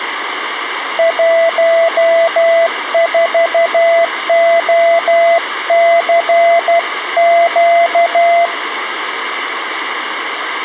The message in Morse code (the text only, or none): 14OCQ